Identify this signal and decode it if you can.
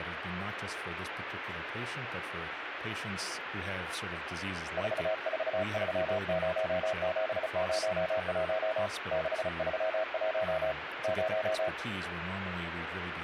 Morse code, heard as a keyed tone, hand-sent with a paddle, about 35 wpm, 640 Hz, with radio static and speech in English. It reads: 4430701 631 0